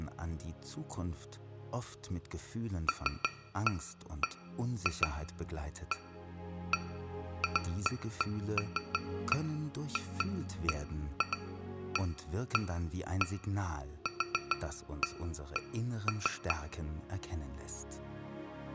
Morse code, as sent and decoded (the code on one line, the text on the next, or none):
none